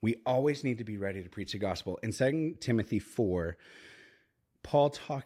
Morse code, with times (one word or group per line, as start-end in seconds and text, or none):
none